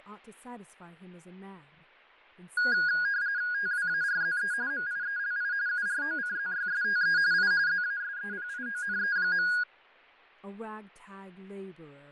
RTTY (45.45 baud, 170 Hz shift), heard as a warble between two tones, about 1550 Hz centre, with fading and speech in English. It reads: TWARZE MIELI UROCZYSTE I ZASEPIONE.